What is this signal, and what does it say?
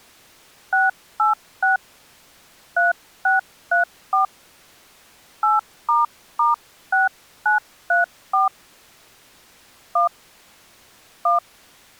DTMF, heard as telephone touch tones, dialled by hand, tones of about 150 ms. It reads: 686 3634 8**6934 1 1